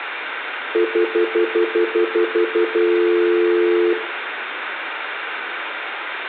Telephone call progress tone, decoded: stutter dial tone

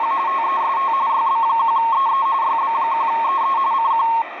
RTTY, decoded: … TEST YB1EE YB1EE CQ

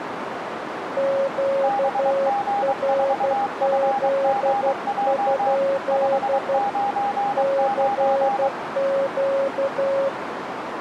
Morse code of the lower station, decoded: QRZ? CQ

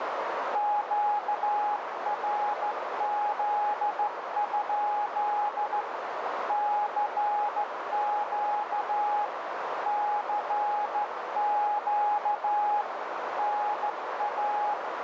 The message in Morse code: QRZ? CQ CQ NA

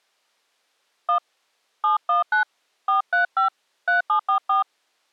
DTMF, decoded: 1 719 435 3744

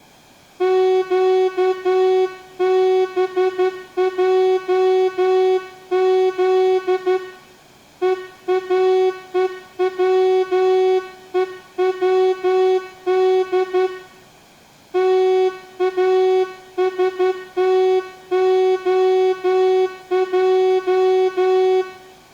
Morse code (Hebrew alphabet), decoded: קבעז ואוצוצד תאשתהע

